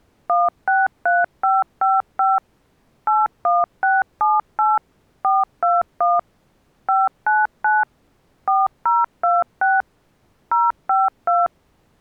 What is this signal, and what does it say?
DTMF, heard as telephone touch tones, dialled by machine, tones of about 190 ms. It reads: 163555 81678 421 599 4026 052